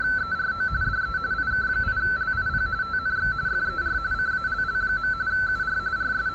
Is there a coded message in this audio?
Yes: RTTY (45.45 baud, 170 Hz shift) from 0.0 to 6.3 s, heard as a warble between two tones, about 1430 Hz centre, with room echo and street noise. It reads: … DE IK8LIP TNX FER CALL. UR …